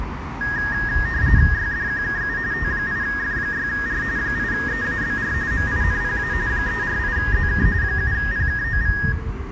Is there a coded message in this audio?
Yes: RTTY (45.45 baud, 170 Hz shift) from 0.4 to 9.1 s, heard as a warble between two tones, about 1750 Hz centre, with room echo and street noise. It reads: YDQKU T8F6R 8EABR MINPA 348ZK 7PKOV